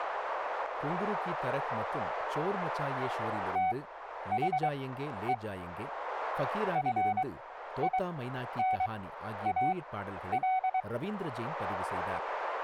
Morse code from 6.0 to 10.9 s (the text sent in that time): FINAL